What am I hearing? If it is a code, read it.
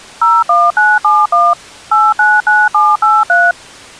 DTMF, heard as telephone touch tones, dialled by machine, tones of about 210 ms. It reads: 01971 899783